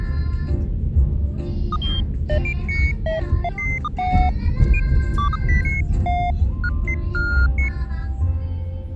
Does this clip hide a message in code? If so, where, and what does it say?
No, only electronic bleeps of random pitch and length, with the noise inside a car.